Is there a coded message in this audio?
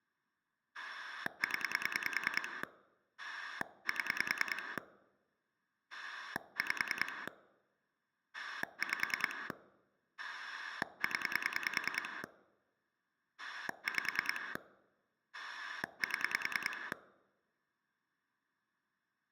Yes: pulse dialling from 0.7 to 16.9 s, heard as a rotary dial, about 10 pulses a second. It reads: 0 7 5 5 0 5 7